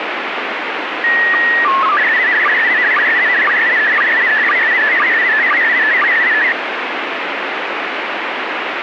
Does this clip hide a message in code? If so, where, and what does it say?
Yes: SSTV (slow-scan television), PD 120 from 1.0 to 6.5 s, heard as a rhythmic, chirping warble, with radio static.